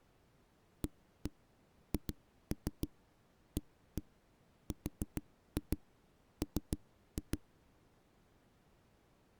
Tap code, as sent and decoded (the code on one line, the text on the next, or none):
1-1 2-3 1-1 4-2 3-2
AHARM